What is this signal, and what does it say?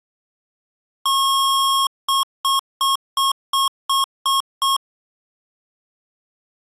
Beep code, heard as beeps from a small speaker, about 1090 Hz. 1 long, 8 short. In AMI BIOS tables: display or retrace test failure.